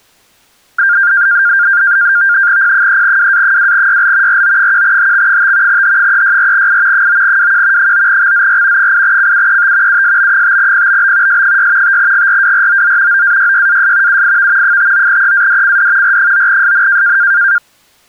NAVTEX (SITOR-B), 100 baud, 170 Hz shift, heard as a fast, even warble, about 1500 Hz centre. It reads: P3WA2YL RO1HX5 H364I 9WQ 9XZR 8CUET USB5PBB S6 5GRWROZ OAYYAS UIV 59EADCD R9SN